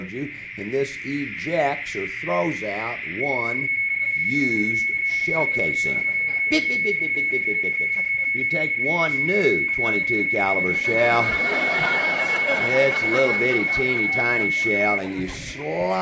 PSK31 (31.25 baud), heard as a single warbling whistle, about 2200 Hz, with radio static and a narrow filter.